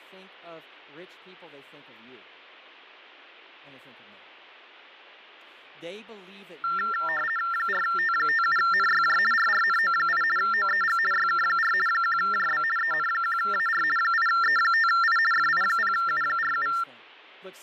RTTY (50 baud, 450 Hz shift), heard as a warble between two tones, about 1600 Hz centre, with fading and speech in English. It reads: 4T57NYJ RRNO8 OEG YK4 1JB EN1AR 8E5I FI0U47